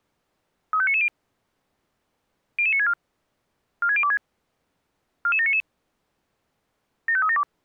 Five-tone selective call (ZVEI), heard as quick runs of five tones, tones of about 70 ms. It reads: 35990 00964 46026 44799 75372